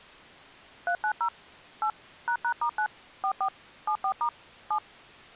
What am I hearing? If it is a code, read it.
DTMF, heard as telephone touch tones, dialled by machine, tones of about 80 ms. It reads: 390 8 ##*9 44 74* 7